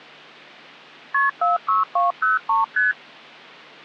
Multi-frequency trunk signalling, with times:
1.1-1.3 KP
1.4-2.6 46203
2.8-2.9 ST

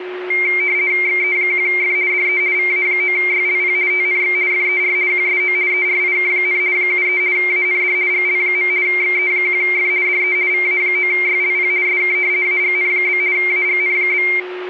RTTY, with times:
1.1-2.0 XE1F
2.1-2.4 DE
2.6-3.8 VA9YLP
3.9-4.4 TNX
4.5-5.0 FER
5.1-5.6 QSO
5.7-6.6 ERIK,
6.8-7.2 73
7.4-8.0 AND
8.1-8.7 GL.
8.9-9.9 XE1F
10.1-10.4 DE
10.5-11.7 VA9YLP
11.9-12.2 SK
12.5-13.2 AGN?
13.4-14.3 AGN?

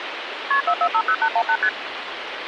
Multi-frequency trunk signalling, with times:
0.5-0.6 KP
0.7-1.6 4450818
1.6-1.7 ST

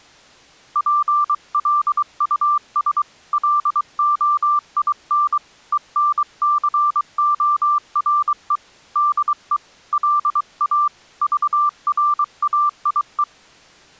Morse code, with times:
0.8-3.0 PLUS
3.3-5.4 LOIN
5.7-8.6 ENCORE
9.0-9.6 DE
9.9-10.9 LA
11.2-13.2 VRAIE

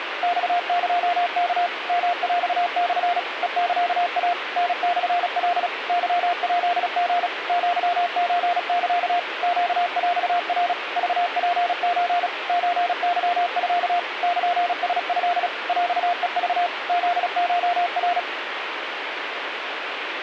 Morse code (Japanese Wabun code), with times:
0.2-1.7 マエワ
1.9-3.2 ヨヰモ
3.4-4.3 ヘサイ
4.6-5.7 タモカ
5.9-7.3 ケヱリ
7.5-9.2 アソサ
9.4-10.7 ネヰナ
11.0-12.3 クツソ
12.5-14.0 ソケミ
14.2-15.5 ルラト
15.7-16.7 ヰヘク
16.9-18.2 フコナ

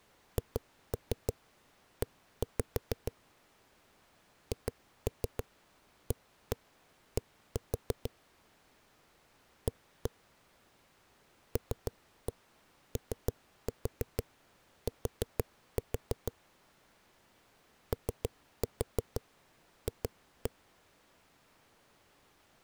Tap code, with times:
0.4-3.1 HE
4.5-8.1 HAD
9.7-10.1 A
11.6-16.3 LOT
17.9-20.5 OF

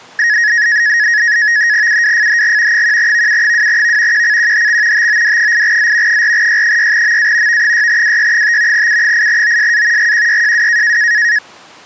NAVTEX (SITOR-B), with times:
1.9-2.8 UWFHG
2.7-4.2 1VU2V
4.1-5.1 QCQHX
4.9-6.2 TOD8Z
6.1-7.6 4Y6MA
7.5-8.9 V6WY5
8.7-10.1 U8OSA
10.0-11.0 GQYJW

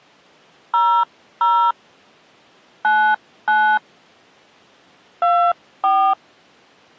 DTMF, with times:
0.7-1.7 00
2.8-3.8 99
5.2-6.1 24

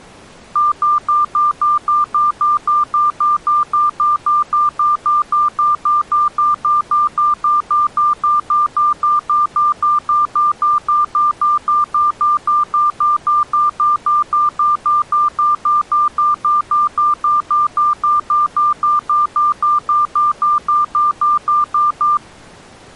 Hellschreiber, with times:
none

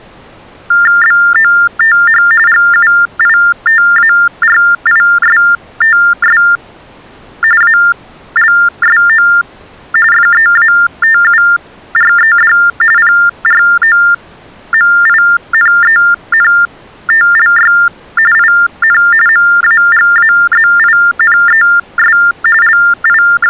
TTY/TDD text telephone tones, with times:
1.0-2.2 BOTH
2.5-6.4 GUITARISTS
7.6-9.3 ALSO
10.1-12.5 FEATURED
13.0-17.7 PROMINENTLY
18.3-19.0 IN
19.3-22.2 MAGAZINES
22.6-23.5 …

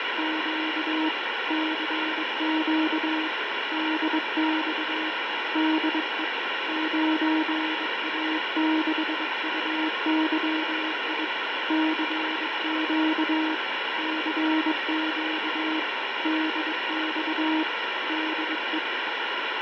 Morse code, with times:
0.0-1.1 …
1.5-3.3 CQ
3.7-5.1 DX
5.6-6.2 DE
6.7-11.2 9A6UYI
11.7-13.5 CQ
14.0-15.8 CQ
16.2-17.6 DX
18.1-18.8 DE

